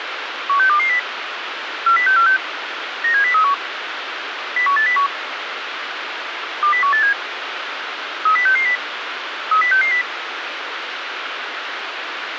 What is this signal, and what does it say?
Five-tone selective call (CCIR), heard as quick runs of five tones, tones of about 100 ms, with radio hiss. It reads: 16220 40646 97031 01801 20187 30660 30660